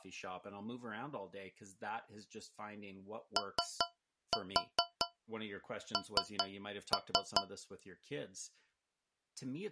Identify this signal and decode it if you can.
Tap code, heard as taps on a metal pipe, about 4 knocks a second, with speech in English. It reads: ON